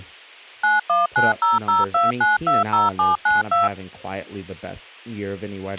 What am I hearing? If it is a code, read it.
DTMF, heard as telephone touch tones, dialled by machine, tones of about 160 ms, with a squelch burst at the end and speech in English. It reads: 919002920792